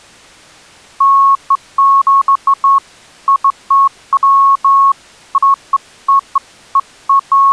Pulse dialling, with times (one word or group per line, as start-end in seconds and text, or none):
none